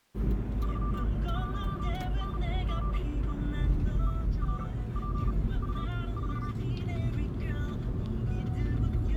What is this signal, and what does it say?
Morse code, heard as a keyed tone, machine-sent, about 38 wpm, spaced as for 20 wpm, 1180 Hz, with the noise inside a car. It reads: 31NGE ERPU4